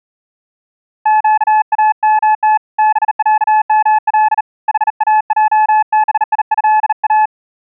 Morse code (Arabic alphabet), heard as a keyed tone, hand-sent with a bug key, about 38 wpm, 860 Hz. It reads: قامت بعمل حاجبيها